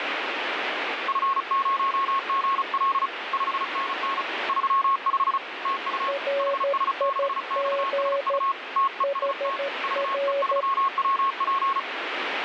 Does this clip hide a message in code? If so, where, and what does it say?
Yes: Morse code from 1.0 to 11.9 s, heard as two keyed tones, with radio static. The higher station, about 35 wpm, 1090 Hz: F0GL 5NN 35 TU HS6XSU TEST VE3WP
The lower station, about 13 wpm, 560 Hz: RIG HR